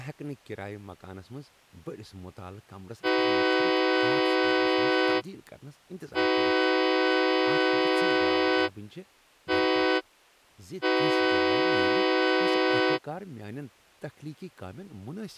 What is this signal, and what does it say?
Train horn signal, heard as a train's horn, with speech in Kashmiri. 2 long, 1 short, 1 long. On North American railways: approaching a public crossing.